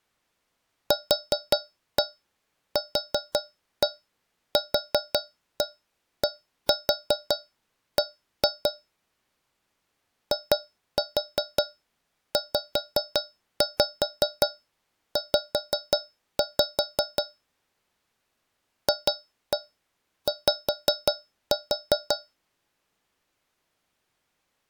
Tap code, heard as taps on a metal pipe, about 5 knocks a second. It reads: QQQDB IZZ FY